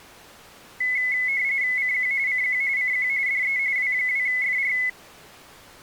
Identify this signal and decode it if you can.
RTTY (45.45 baud, 170 Hz shift), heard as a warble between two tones, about 2100 Hz centre. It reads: CQ CQ CQ DE W2FR